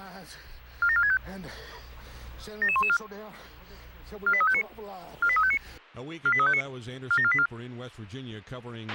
Five-tone selective call (ZVEI), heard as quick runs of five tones, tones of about 70 ms, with a squelch burst at the end. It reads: 47465 77114 48359 48359 48359 47484